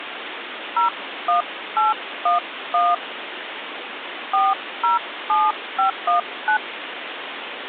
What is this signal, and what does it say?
DTMF, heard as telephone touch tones, dialled by hand, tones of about 150 ms, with phone line noise. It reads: 01811 407519